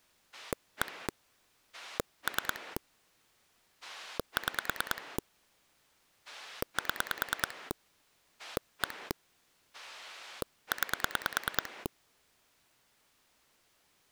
Pulse dialling, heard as a rotary dial, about 9 pulses a second. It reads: 1 3 6 7 1 9